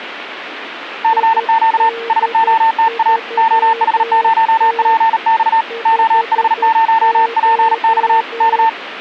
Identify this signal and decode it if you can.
Morse code, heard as a keyed tone, hand-sent with a bug key, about 38 wpm, 900 Hz, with radio static and a weaker station near 460 Hz. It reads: CQ SOTA OH0PX OH0PX K